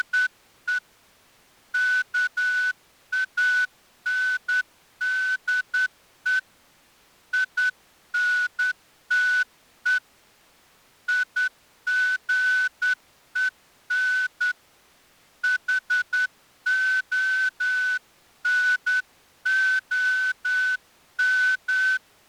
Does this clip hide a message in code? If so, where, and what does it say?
Yes: Morse code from 0.0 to 22.0 s, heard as a whistle, hand-sent with a straight key, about 10 wpm. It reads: … KANDE INTE IGEN HONOM